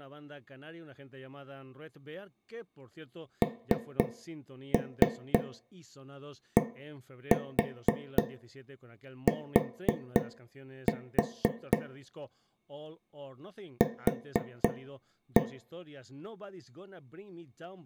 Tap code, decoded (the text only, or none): NDT Q